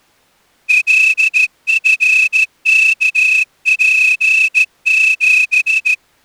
Morse code, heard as a whistle, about 14 wpm. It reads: LFKP7